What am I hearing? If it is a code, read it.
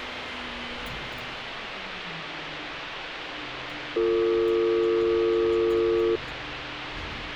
Telephone call progress tone (North American or UK plan), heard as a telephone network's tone, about 350, 450 Hz, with phone line noise and street noise. Dial tone.